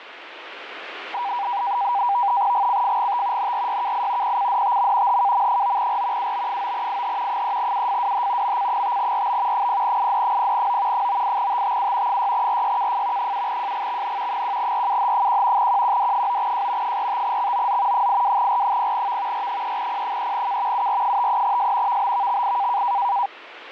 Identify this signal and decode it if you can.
NAVTEX (SITOR-B), 100 baud, 170 Hz shift, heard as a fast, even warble, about 880 Hz centre, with radio static. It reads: GCFGT NRYKI PCDTM HKM9R UB9IH 3UFWH MC5RB 0ID0O 98TTU 6RYKF 7JGXN 1RUH1 QQD9J 45XOZ 82R0V R3P3K UR53S VBVXI